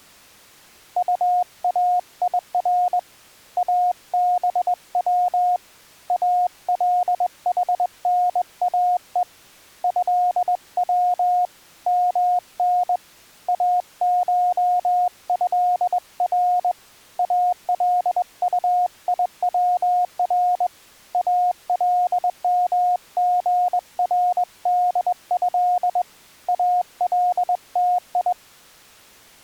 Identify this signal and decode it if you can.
Morse code (Arabic alphabet), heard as a keyed tone, hand-sent with a straight key, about 21 wpm, 720 Hz. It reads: طاير ابو الحناء هو من اشهر الطيور المغرده التي